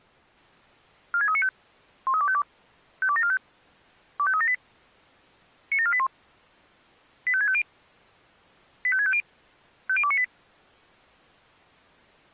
Five-tone selective call (ZVEI), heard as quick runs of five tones, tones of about 70 ms. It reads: 46395 13252 52745 25378 97481 85650 85650 50298